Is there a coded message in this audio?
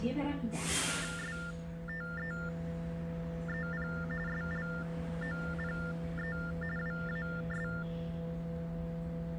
Yes: TTY/TDD text telephone tones (45.45 baud Baudot) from 0.9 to 7.8 s, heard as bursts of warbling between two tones, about 400 Hz shift, 1600 Hz centre, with the noise inside a bus. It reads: STEEP SLOPE WAS